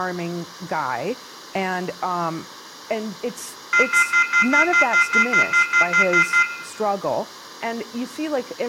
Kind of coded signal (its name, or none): telephone call progress tone